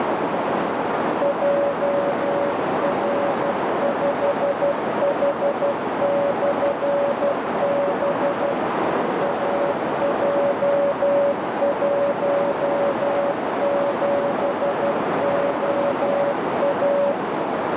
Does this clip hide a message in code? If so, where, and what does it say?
Yes: Morse code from 1.2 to 17.2 s, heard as a keyed tone, machine-sent, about 12 wpm, 570 Hz, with heavy radio static and a narrow filter. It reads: JR5H/B AJ17OA